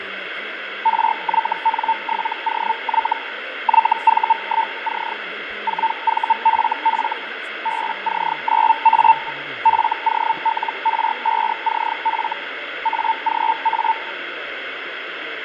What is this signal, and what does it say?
Hellschreiber (Feld-Hell, 122.5 baud), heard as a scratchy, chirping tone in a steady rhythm, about 900 Hz, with radio static and fading. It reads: RYN7OY YV1C 4VFF BC9A FOLR5CF AGA